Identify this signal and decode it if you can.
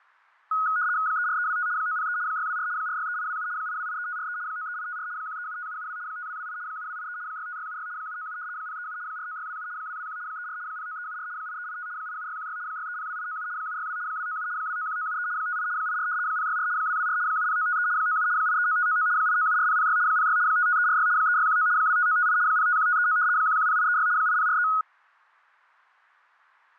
RTTY (75 baud, 170 Hz shift), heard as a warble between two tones, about 1360 Hz centre, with fading. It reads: 34325 903 624 463827 8283543 93854 1375772 5228 7283 65676 797 037 49627 221 34 09374 8385 87616 6302897 762 297 291973 58 84 064 224 70953 97 839599 8974006 06 55346 3619 25958 051539 110836 8043